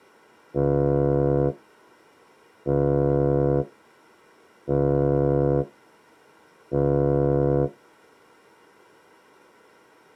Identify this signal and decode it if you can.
Ship horn signal, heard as a ship's horn, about 70 Hz. 4 short. At sea: a pilot vessel's identity signal in fog.